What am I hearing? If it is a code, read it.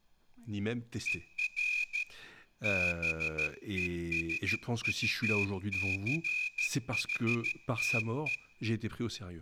Morse code, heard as a whistle, hand-sent with a straight key, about 13 wpm, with room echo and speech in French. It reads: ER BESUCHTE